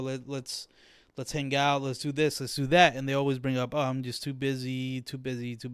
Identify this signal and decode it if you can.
Speech in English. There is no code.